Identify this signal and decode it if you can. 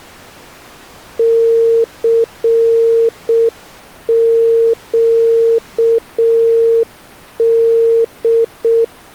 Morse code, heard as a keyed tone, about 6 wpm, 460 Hz. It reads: CQD